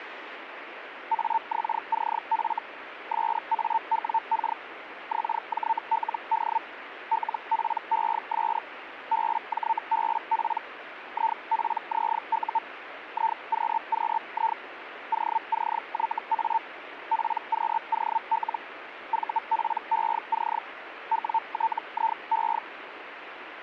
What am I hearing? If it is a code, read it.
Hellschreiber (Feld-Hell, 122.5 baud), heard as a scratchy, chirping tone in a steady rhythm, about 900 Hz, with radio static. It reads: AXCF SAWK XJLD LPES BJBP IPZU IQQI OCYA PQOL VPEC WTIE